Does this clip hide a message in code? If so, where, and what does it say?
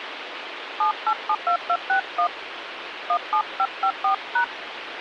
Yes: DTMF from 0.8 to 4.4 s, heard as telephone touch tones, dialled by hand, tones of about 80 ms, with phone line noise. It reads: 7872261 17554#